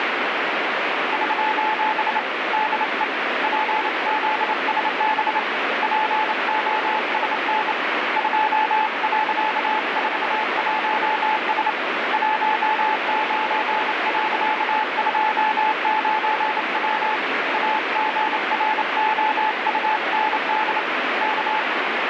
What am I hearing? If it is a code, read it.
Morse code, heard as a keyed tone, hand-sent with a bug key, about 28 wpm, 860 Hz, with heavy radio static. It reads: <SOS> DE PZSB POSN 2.41S 19.29W AGROUND K